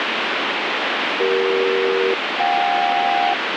Aircraft SELCAL, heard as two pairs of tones, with heavy radio static. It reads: CE-JK